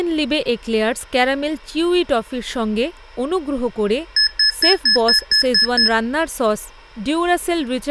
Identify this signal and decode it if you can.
Beep code, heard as beeps from a small speaker, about 1700 Hz, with speech in Bangla. 8 short. In AMI BIOS tables: display memory failure; in Dell tables: LCD failure.